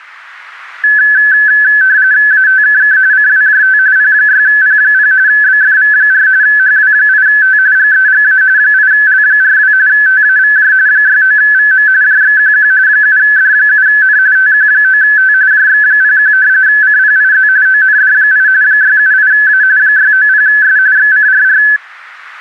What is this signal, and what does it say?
RTTY (45.45 baud, 170 Hz shift), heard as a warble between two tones, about 1600 Hz centre. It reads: ATKK CWJT P6P0 BFV4 HW8T GEGA 8L42 TAVJ 69VM JXQQ 7D7N TQ9T JX01 CPIZ OND8 678A 690S XCRR